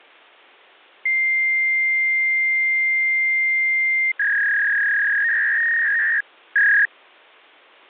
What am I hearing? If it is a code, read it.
Fax machine handshake, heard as a long tone and a warble.